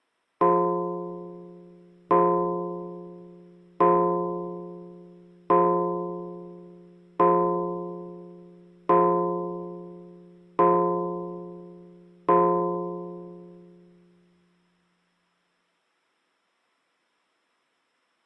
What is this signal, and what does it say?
Clock strike, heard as a bell. 8. Eight o'clock.